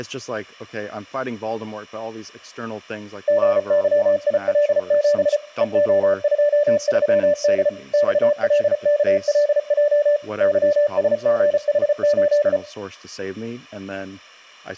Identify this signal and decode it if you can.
Morse code, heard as a keyed tone, machine-sent, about 34 wpm, 590 Hz, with speech in English. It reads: GYIL7 EO23D XLKLJ YSGH8